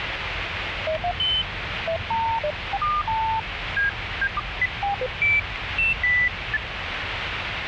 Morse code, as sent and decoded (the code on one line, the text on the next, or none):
none